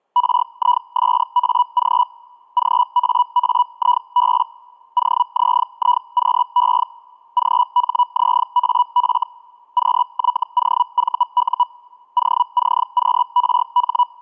Hellschreiber (Feld-Hell, 122.5 baud), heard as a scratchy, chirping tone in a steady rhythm, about 980 Hz. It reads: RISAG GAAIB OZIQE GHZAF QYOVU OCQRH